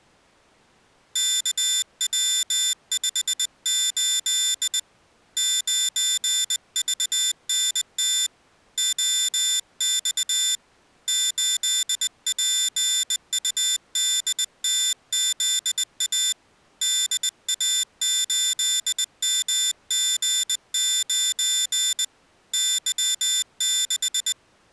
Morse code, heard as a high beeper, hand-sent with a bug key, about 20 wpm, 3550 Hz. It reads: KW58 9VNT OX 8PUDTZA DA8MG9 Y6